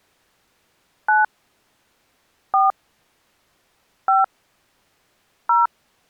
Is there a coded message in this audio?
Yes: DTMF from 1.1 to 5.7 s, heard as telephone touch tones, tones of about 160 ms. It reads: 9 4 5 0